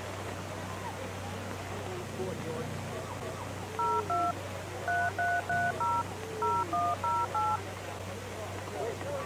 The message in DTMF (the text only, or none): 02 3330 0108